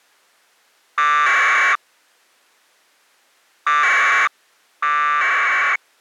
Packet radio (AX.25, as in APRS), 1200 baud, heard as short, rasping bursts.